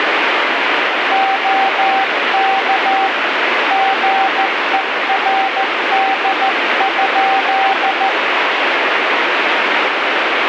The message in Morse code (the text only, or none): OK GERD?